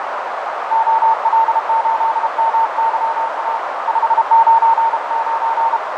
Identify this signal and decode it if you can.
Morse code, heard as a keyed tone, hand-sent with a paddle, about 32 wpm, 910 Hz, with heavy radio static, fading and a narrow filter. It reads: OL8MYA 599